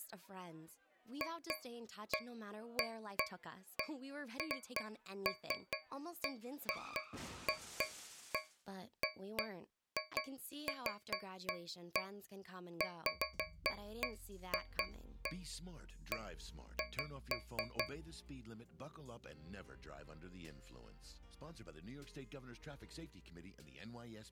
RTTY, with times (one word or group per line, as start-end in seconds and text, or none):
none